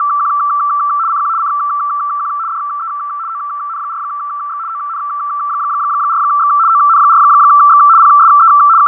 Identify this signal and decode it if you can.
RTTY (75 baud, 170 Hz shift), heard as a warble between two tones, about 1250 Hz centre, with radio static and fading. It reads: … CQ CQ DE ON4X ON4X ON4X PSE …